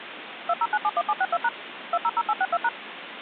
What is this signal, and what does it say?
DTMF, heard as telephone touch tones, dialled by machine, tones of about 50 ms, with phone line noise. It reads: 20971762# 200862#